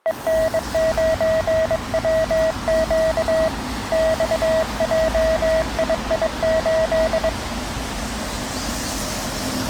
Morse code, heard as a keyed tone, hand-sent with a bug key, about 22 wpm, 640 Hz, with street noise. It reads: EN9WQ XJII8